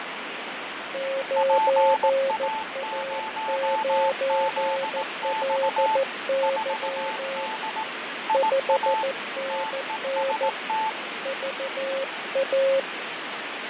Morse code, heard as two keyed tones, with heavy radio static and fading. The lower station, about 14 wpm, 540 Hz: 9A9LY 5NN VA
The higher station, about 18 wpm, 880 Hz: PA0ZX 4D IA TEST